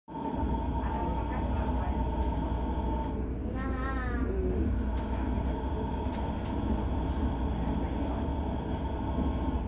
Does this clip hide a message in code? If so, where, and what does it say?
No, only the noise inside a subway train.